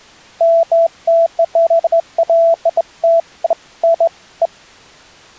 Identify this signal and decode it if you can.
Beeps of irregular length. There is no code.